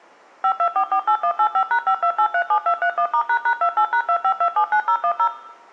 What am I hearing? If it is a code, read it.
DTMF, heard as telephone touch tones, dialled by machine, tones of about 80 ms, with room echo. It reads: 52448185#52837231*##28#25279010